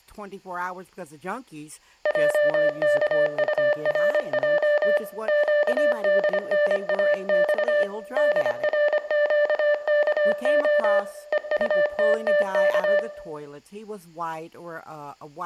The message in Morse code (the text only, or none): JKURJ QDNAX DRQKO EUTTK